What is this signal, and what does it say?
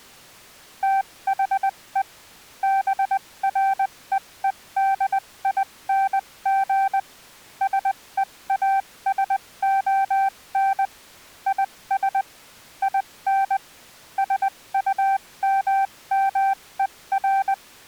Morse code, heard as a keyed tone, machine-sent, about 20 wpm, spaced as for 17 wpm, 780 Hz. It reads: THE BREEDING SEASON IS IN SUMMER